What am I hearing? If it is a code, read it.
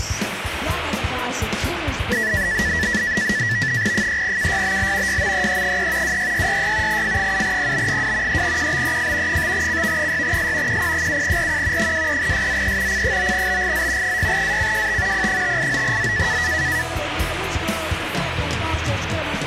NAVTEX (SITOR-B), 100 baud, 170 Hz shift, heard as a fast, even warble, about 1850 Hz centre, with radio static. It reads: 3KYBL YMEE3 26666 F7PB2 3QBEF 5CV6S QP7RQ 23SZE C9BGZ 6ACJT P589Z